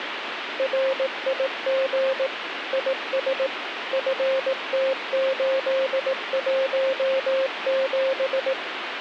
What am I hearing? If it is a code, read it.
Morse code, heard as a keyed tone, machine-sent, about 18 wpm, 530 Hz, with radio static. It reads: RIG IS FT817